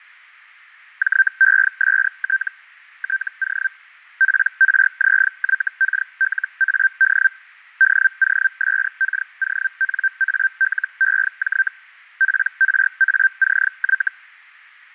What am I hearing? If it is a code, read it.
Hellschreiber (Feld-Hell, 122.5 baud), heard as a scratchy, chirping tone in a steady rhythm, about 1550 Hz, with fading. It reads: JEST TO PRZYKLAD DOSKONALEJ PRACY